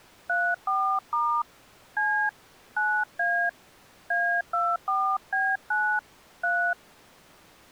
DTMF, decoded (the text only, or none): 34* C 9A A24B9 3